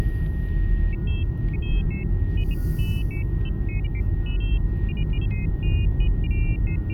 Pairs of high tones at irregular times, with static crashes, a steady whistle near 1870 Hz and the noise inside a car. There is no code.